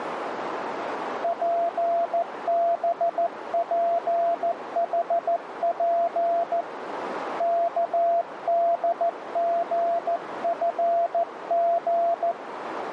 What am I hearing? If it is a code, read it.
Morse code, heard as a keyed tone, hand-sent with a paddle, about 14 wpm, 680 Hz, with radio static and a narrow filter. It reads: PBPHP KDGFG